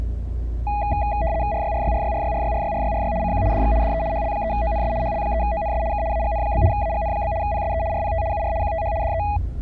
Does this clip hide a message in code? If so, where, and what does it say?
Yes: RTTY (75 baud, 170 Hz shift) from 0.7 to 9.4 s, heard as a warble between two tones, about 740 Hz centre, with the noise inside a car. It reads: RYRYRYRYRYRYRYRY CQ DX DE HL3ONS HL3ONS K AGN? AGN? PSE RPT UR QTH DE